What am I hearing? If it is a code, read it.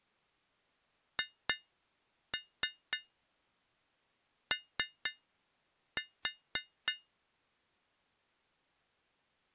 Tap code, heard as taps on a metal pipe, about 3 knocks a second. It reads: HO